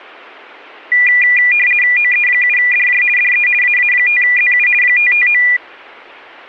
RTTY (50 baud, 450 Hz shift), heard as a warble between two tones, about 2200 Hz centre. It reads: OE7DJ DE AA5ZU 559